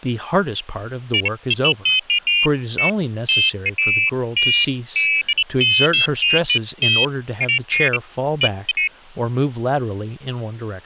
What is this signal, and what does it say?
Pairs of high tones at irregular times, with speech in English. There is no code.